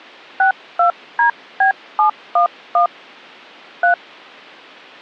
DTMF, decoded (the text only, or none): 62DB711 3